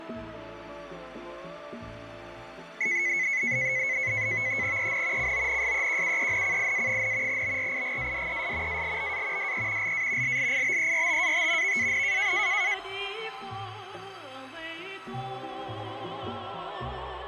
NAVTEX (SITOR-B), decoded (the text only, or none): EN CONSEQUENCIA, BRIGADES ALBA DE LA LLIBERTAT VAN